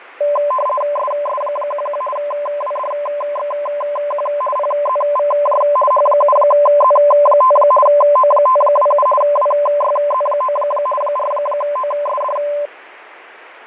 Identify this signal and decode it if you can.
RTTY (50 baud, 450 Hz shift), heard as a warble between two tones, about 810 Hz centre, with radio static and fading. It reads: SS11 WDXQ PZVJ H7Z5 O527 WYZ9 4OSD